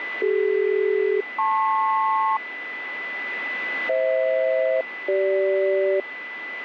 Aircraft SELCAL, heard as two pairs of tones, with radio static and a steady whistle near 2000 Hz. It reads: CD-LP FH-CG